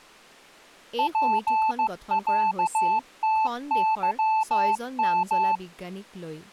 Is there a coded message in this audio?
Yes: Morse code (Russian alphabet) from 0.9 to 5.6 s, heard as a keyed tone, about 15 wpm, 880 Hz, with speech in Assamese. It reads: ПЯТЫМ